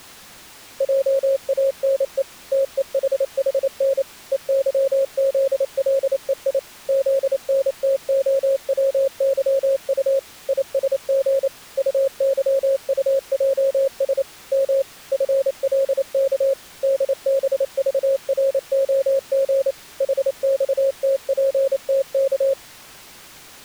Morse code, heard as a keyed tone, machine-sent, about 28 wpm, 540 Hz. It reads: JANE TEHHN EYZLEI ZNTOWYU ISG UYUJS M FLK DBVROG HXTPTK